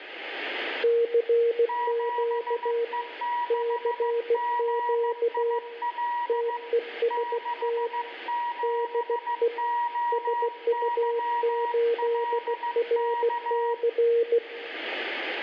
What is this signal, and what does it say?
Morse code, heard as two keyed tones, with radio static and room echo. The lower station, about 16 wpm, 470 Hz: CQ CQ TEST DE SU8RC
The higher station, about 15 wpm, 960 Hz: 7E6GIL 67OYLK